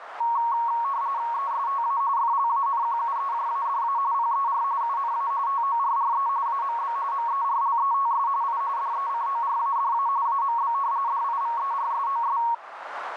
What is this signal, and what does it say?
RTTY (45.45 baud, 170 Hz shift), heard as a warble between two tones, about 1020 Hz centre, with radio static and a narrow filter. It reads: ESTA FLANQUEJADA PER UNA TORRE AMB MERLETS I DECORADA AMB DIVERSOS